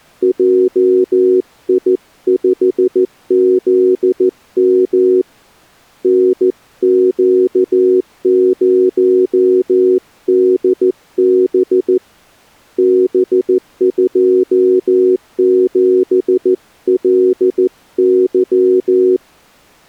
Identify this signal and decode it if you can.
Morse code, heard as a keyed tone, hand-sent with a paddle, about 14 wpm, 370 Hz. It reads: JI5ZM NQ0DB B27LY